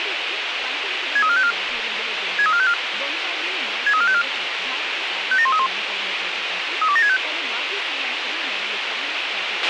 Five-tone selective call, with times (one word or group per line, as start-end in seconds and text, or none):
1.2-1.5 63454
2.4-2.7 63454
3.9-4.2 63454
5.3-5.7 57131
6.8-7.2 32765